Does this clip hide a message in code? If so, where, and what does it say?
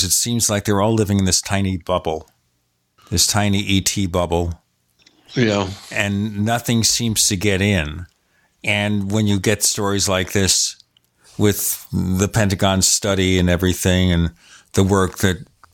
No, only speech in English.